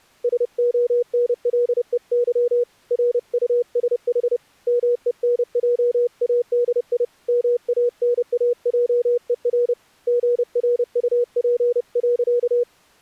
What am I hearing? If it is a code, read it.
Morse code, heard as a keyed tone, hand-sent with a paddle, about 30 wpm, 480 Hz. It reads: SONLEY RUSH MENJADI MANAJER GRUP.